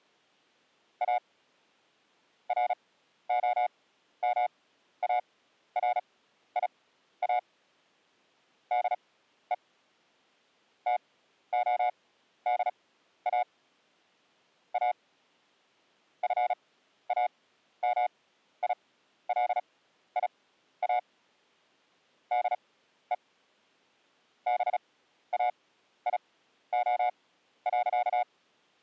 Morse code, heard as a keyed tone, machine-sent, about 36 wpm, spaced as for 13 wpm, 720 Hz. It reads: A ROMARIA DE TODA A FAMILIA DE BAIO.